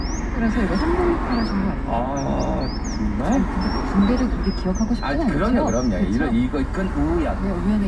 Bird-like chirps, with room echo and the noise inside a car. There is no code.